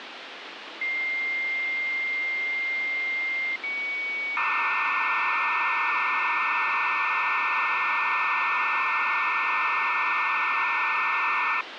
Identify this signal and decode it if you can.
Dial-up modem handshake (low-speed, two carriers), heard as two whistles, then hiss, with phone line noise.